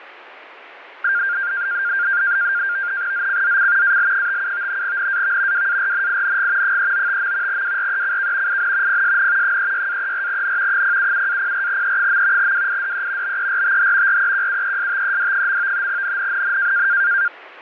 NAVTEX (SITOR-B), 100 baud, 170 Hz shift, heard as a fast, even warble, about 1500 Hz centre, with radio static. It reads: ZCZC AL57 NAV WARNING 395. WRECK IN PSN 36-34N 077-04E. WIDE BERTH REQUESTED. NNNN